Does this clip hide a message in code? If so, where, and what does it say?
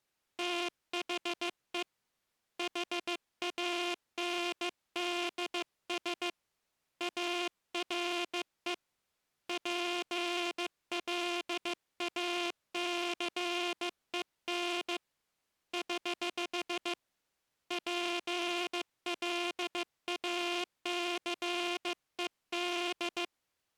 Yes: Morse code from 0.3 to 23.3 s, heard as a buzzer, hand-sent with a bug key, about 15 wpm. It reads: THE HANDS ARE PLACEN <HH> PLACED